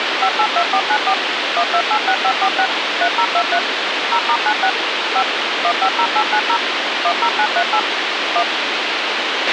DTMF, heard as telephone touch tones, dialled by machine, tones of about 70 ms, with radio hiss and a squelch burst at the end. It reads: 582494 1286546 3023 0*96 5 150890 10938 1